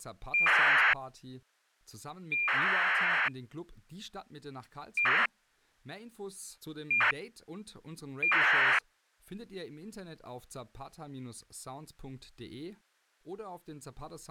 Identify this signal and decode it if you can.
ACARS aircraft data, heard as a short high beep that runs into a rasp, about 2400 baud, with speech in English.